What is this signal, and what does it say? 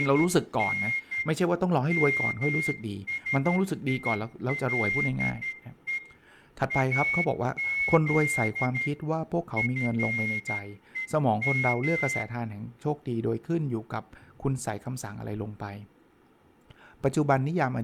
Morse code (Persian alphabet), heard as a whistle, hand-sent with a straight key, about 12 wpm, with room echo and speech in Thai. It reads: … مسیله از فهم